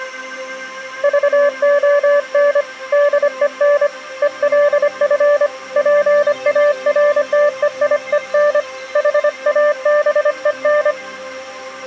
Morse code, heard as a keyed tone, hand-sent with a paddle, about 25 wpm, 580 Hz. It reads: VON DEN ELF PARTEIEN HABEN